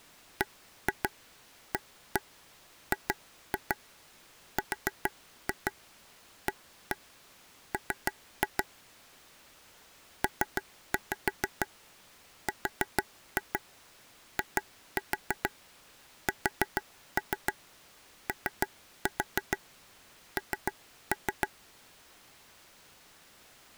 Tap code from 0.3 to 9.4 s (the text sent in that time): BAGRAM